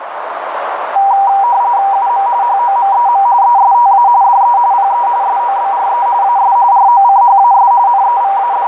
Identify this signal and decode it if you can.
RTTY (45.45 baud, 170 Hz shift), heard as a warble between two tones, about 870 Hz centre, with radio static and a narrow filter. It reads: UM HOMEM ESTA DE PE SOBRE AS ROCHAS …